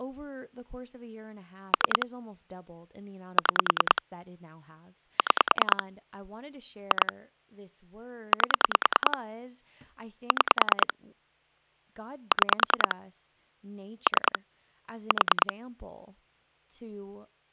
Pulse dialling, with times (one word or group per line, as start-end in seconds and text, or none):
1.7-2.1 3
3.4-4.0 6
5.2-5.8 6
6.9-7.1 2
8.3-9.2 8
10.3-10.9 6
12.3-12.9 6
14.1-14.4 3
15.1-15.5 4